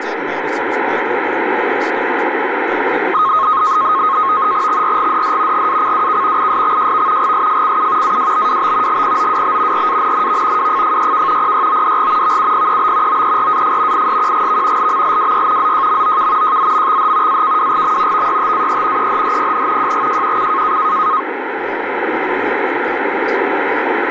NAVTEX (SITOR-B), 100 baud, 170 Hz shift, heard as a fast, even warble, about 1170 Hz centre, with radio static and speech in English. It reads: XRGDD GACWK ISXJV GSFCU AWBWB GPOWB RANNV WFFYK PYODG VUPEB OERAF ISQGV LMLWY ZJMOK JZMXH AKWGM VYTAE EHHPN JGJQC